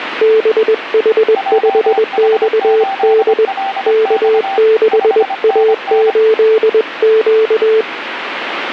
Morse code, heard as two keyed tones, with radio static. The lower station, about 21 wpm, 440 Hz: BH5XD K6A8Q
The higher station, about 25 wpm, 780 Hz: JH8LX 5NN